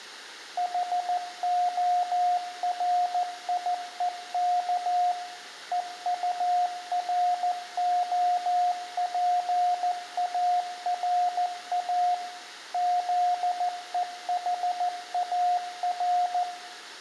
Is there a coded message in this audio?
Yes: Morse code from 0.5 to 16.5 s, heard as a keyed tone, machine-sent, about 14 wpm, 720 Hz, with room echo. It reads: HORIEK EUROPARA ZEHAR